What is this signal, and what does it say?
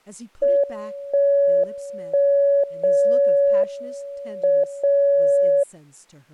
Radio time signal (WWVB), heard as a tone whose level steps once a second, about 560 Hz, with speech in English. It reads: 1 1 0 M 0